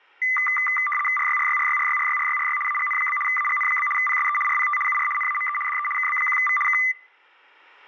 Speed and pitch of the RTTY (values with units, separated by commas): 75 baud, 850 Hz shift, 1600 Hz centre